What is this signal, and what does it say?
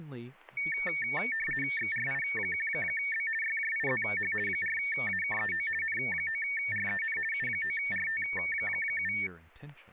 RTTY (50 baud, 450 Hz shift), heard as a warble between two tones, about 2000 Hz centre, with static crashes and speech in English. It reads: XRI1B YJIZH 4AKEO N9REN U9RT7